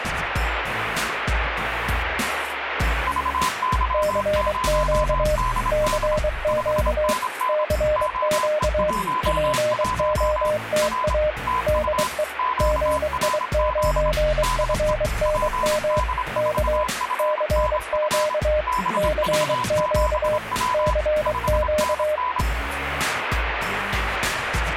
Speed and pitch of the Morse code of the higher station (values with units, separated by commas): 26 wpm, 1010 Hz